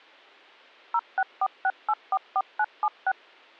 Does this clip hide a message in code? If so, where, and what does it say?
Yes: DTMF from 0.9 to 3.1 s, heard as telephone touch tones, dialled by machine, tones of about 50 ms. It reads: 0646844976